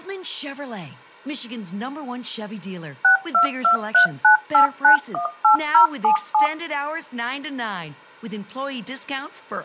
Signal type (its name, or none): DTMF